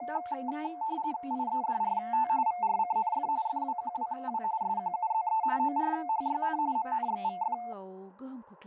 RTTY (45.45 baud, 170 Hz shift), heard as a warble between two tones, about 800 Hz centre, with speech in Bodo. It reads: IEDRT VRCNF FWQWW SQUZE ORHYN MNXVF